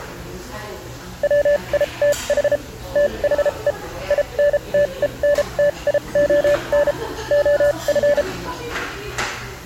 Morse code, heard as a keyed tone, machine-sent, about 33 wpm, spaced as for 27 wpm, 580 Hz, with the noise of a restaurant. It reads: WITH THE INTENTION OF